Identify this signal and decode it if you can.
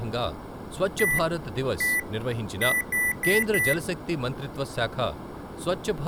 Beep code, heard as beeps from a small speaker, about 2000 Hz, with speech in Telugu. 1-1-4. In Phoenix BIOS tables: BIOS ROM checksum failure.